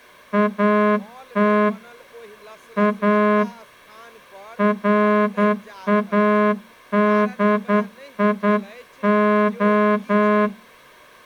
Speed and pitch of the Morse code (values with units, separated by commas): 9 wpm